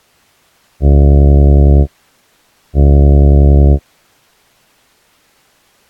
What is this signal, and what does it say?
Ship horn signal, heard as a ship's horn, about 70 Hz. 2 short. At sea: I am altering course to port.